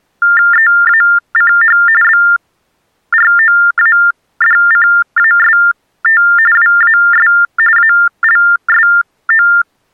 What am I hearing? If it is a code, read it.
TTY/TDD text telephone tones (45.45 baud Baudot), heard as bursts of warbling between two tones, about 400 Hz shift, 1600 Hz centre. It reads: EACH BROADCAST WAS ALSO